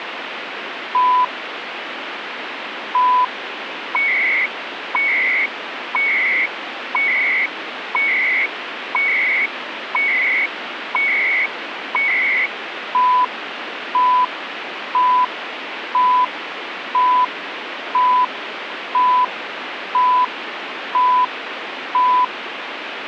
Radio time signal (CHU, Canada), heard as beeps and data bursts, one a second, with radio static.